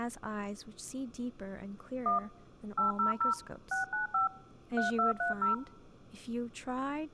DTMF, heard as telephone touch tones, dialled by machine, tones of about 130 ms, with speech in English. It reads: 1 800 695 3230